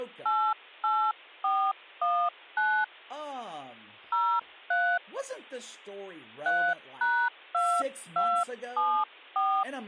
DTMF, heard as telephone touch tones, dialled by hand, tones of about 280 ms, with speech in English. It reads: 88419 03 3#2274